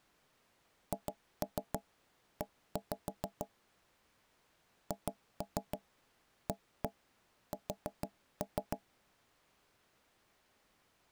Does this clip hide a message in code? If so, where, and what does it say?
Yes: tap code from 0.9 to 8.8 s, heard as knocks on wood, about 6 knocks a second. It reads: HE HAS